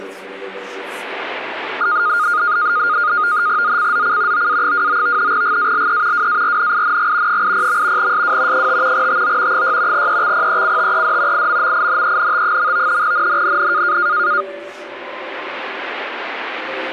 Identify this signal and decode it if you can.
NAVTEX (SITOR-B), 100 baud, 170 Hz shift, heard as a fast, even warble, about 1330 Hz centre. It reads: ZCZC OA29 GALE WARNING 80. SW 5 TO 6 EXPECTED IMMINENT. NNNN